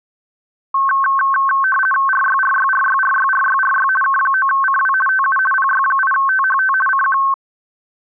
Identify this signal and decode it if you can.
RTTY (50 baud, 450 Hz shift), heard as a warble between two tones, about 1310 Hz centre. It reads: RYRYRYRYRYRY K9CW TU PY8THT CQ